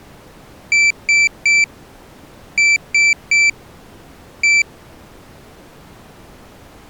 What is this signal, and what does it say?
Beep code, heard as a piezo beeper, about 2350 Hz. 3-3-1.